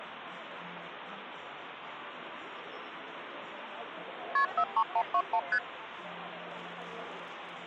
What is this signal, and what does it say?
Multi-frequency trunk signalling (R1, as on North American trunks), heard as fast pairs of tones, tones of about 70 ms, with phone line noise and the noise of a cafe. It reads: KP 43121 ST